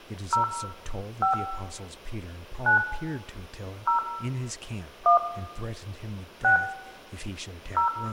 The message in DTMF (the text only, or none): 0 5 9 0 1 6 0